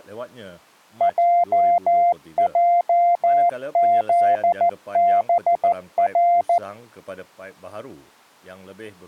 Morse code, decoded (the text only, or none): JJZBR